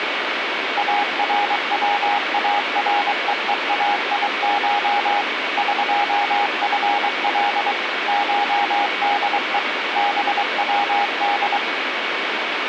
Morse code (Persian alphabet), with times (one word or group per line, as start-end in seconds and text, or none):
0.8-5.2 اروارههایش
5.6-7.7 قفل
8.1-9.6 شده
10.0-11.6 بود